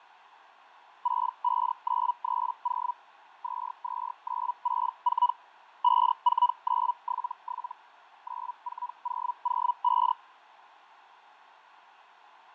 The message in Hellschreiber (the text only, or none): 65930 22964 54977 94005